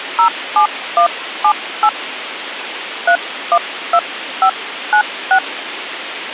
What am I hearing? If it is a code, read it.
DTMF, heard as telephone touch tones, dialled by hand, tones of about 80 ms, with radio hiss and a squelch burst at the end. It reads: 07178 312596